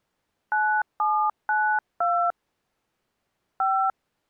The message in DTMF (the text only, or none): 9792 5